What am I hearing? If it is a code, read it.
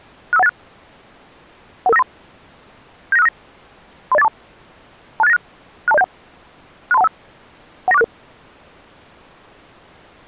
Five-tone selective call (EIA), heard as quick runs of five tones, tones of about 30 ms. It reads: 65186 11593 79659 30842 26896 62071 63215 19466